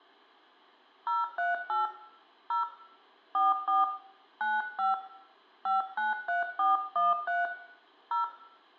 DTMF, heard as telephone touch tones, dialled by hand, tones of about 160 ms, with room echo. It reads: 038 0 44 95 593413 0